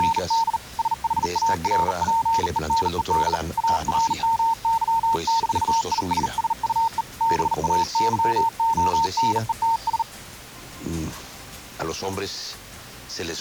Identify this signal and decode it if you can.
Morse code, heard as a keyed tone, hand-sent with a bug key, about 39 wpm, 910 Hz. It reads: … SHARPENED ARMY-ISSUE BAYONETS